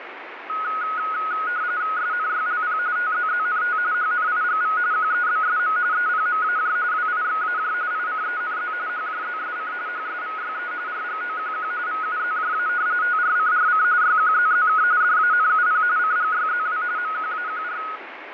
RTTY (45.45 baud, 170 Hz shift), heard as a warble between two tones, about 1360 Hz centre, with radio static and fading. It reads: SNYLP TZZNT HNIGV QEBSM EPMAJ WIXAJ ICENZ HJZSC HSVYE RGOQQ VUZJA TRCRC YQZZK DANUP CGYZW MQAQR